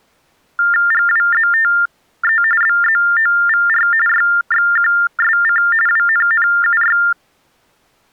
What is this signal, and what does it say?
TTY/TDD text telephone tones (45.45 baud Baudot), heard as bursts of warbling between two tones, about 400 Hz shift, 1600 Hz centre. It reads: GWZTE BZOVR YXQSC WNNUY